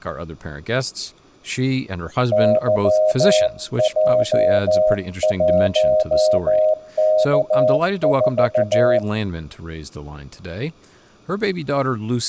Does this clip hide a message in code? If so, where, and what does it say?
Yes: Morse code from 2.3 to 9.0 s, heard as a keyed tone, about 14 wpm, 620 Hz, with room echo and speech in English. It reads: YJ1K4